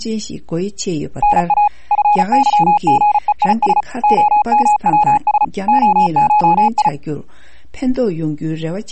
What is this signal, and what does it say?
Morse code (Greek alphabet), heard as a keyed tone, machine-sent, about 35 wpm, 840 Hz. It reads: ΝΑ ΦΥΓΕΙΣ ΟΜΩΣ ΟΧΙ